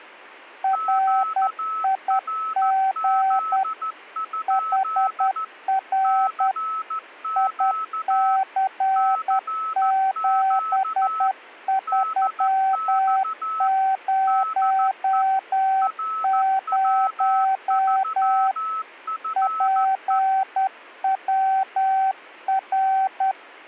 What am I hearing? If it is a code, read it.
Morse code, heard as two keyed tones. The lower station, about 10 wpm, 770 Hz: RIG HR IC7300 PWR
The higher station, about 14 wpm, 1300 Hz: QRZ? CQ CQ DX DE RW3FE